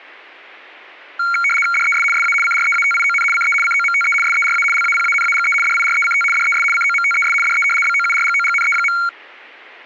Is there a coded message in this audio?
Yes: RTTY (75 baud, 850 Hz shift) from 1.2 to 9.1 s, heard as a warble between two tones, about 1800 Hz centre. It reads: DES SA CREATION CE COMTE SERA LAPANAGE DIRECT DES COMTES DE BOURGOGNE.